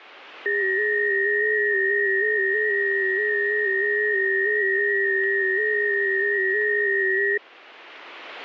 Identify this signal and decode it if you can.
FT8 (several signals at once), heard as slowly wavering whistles, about 6.25 baud.